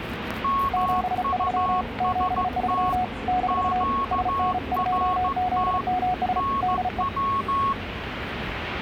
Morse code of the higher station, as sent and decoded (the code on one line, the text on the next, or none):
-- ..- ... - / --.- .-. - / -. .--
MUST QRT NW